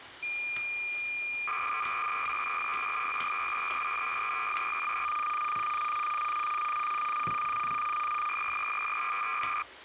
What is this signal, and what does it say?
Cassette data (Kansas City type), 300 baud, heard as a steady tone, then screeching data, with kitchen noise.